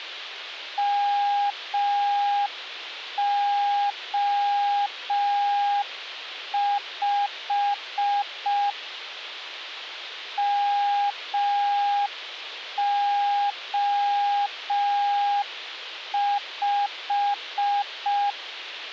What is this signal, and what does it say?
Morse code, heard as a keyed tone, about 5 wpm, 810 Hz, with a squelch burst at the end. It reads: MO5 MO5